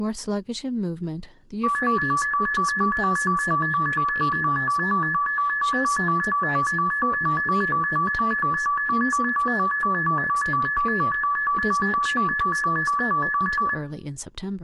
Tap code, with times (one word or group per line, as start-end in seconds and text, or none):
none